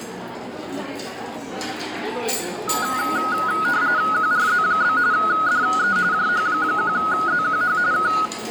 RTTY (45.45 baud, 170 Hz shift), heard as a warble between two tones, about 1360 Hz centre, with the noise of a restaurant. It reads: QRZ? DE JH1ZQH K